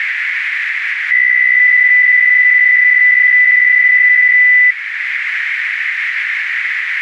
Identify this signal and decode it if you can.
PSK63 (62.5 baud), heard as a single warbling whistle, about 2000 Hz, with radio static and a narrow filter.